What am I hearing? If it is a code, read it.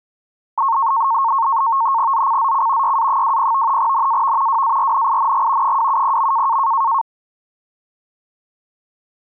NAVTEX (SITOR-B), 100 baud, 170 Hz shift, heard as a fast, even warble, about 1000 Hz centre. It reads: ZCZC YA20 NAV WARNING 270.